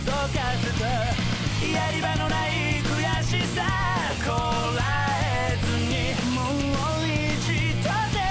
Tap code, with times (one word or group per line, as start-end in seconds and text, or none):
none